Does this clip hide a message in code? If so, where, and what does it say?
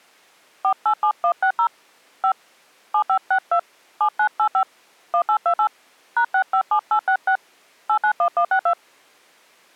Yes: DTMF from 0.6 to 8.7 s, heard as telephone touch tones, dialled by hand, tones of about 80 ms. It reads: 487160 5 7562 7985 1828 #657866 891162